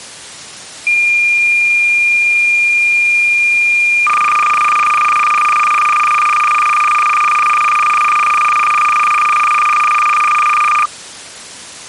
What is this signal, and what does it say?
Cassette data (Kansas City type), 300 baud, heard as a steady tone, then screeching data.